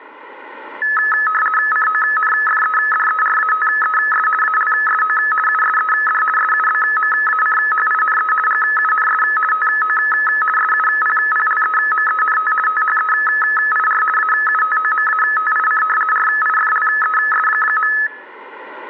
RTTY (50 baud, 450 Hz shift), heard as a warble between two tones, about 1500 Hz centre. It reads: CONFEDERATES ALSO USED SUBMACHINE GUNS TO SUPPLEMENT THEIR AUTOMATIC RIFLES.